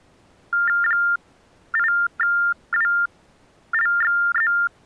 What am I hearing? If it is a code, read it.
TTY/TDD text telephone tones (45.45 baud Baudot), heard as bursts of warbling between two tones, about 400 Hz shift, 1600 Hz centre. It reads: 8WLXZ